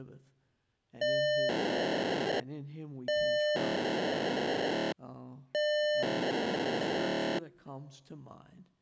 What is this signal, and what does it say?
POCSAG pager data (1200 baud), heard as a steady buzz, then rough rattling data.